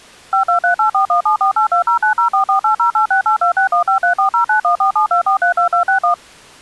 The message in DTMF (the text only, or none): 52384174820904480868261534091472432261